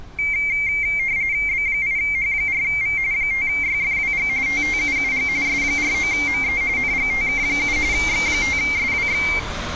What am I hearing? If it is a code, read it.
RTTY (45.45 baud, 170 Hz shift), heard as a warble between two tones, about 2200 Hz centre, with street noise. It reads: B8H4V 5YFWG TTUUG S49ME NGTK7 X5SWX